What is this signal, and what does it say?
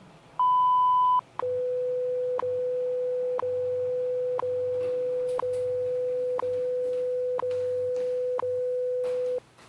Radio time signal (WWV, Colorado), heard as ticks, one a second, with the noise inside a lift.